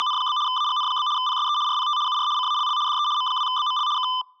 RTTY (75 baud, 170 Hz shift), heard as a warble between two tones, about 1100 Hz centre. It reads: … AGN? PSE RPT UR CALL DE M2BML K